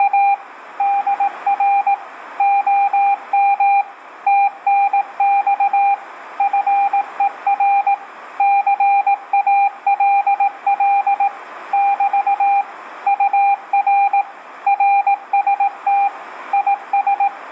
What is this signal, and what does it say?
Morse code, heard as a keyed tone, machine-sent, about 18 wpm, 800 Hz, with radio static and room echo. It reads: … DR OM TNX FER CALL <BT> UR RST IS